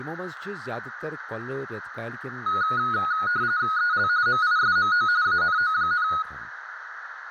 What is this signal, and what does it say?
RTTY (45.45 baud, 170 Hz shift), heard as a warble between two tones, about 1360 Hz centre, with radio static, a narrow filter and speech in Kashmiri. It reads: EL MISMO ANO,